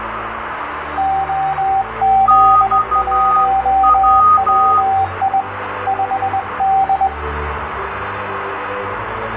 Morse code, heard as two keyed tones, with radio static and room echo. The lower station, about 21 wpm, 780 Hz: OZ1WI 5D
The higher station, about 12 wpm, 1240 Hz: XW